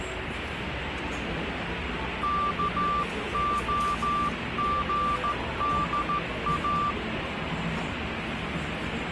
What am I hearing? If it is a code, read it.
Morse code (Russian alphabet), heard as a keyed tone, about 14 wpm, 1180 Hz, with radio static and the noise of a cafe. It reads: КОГДА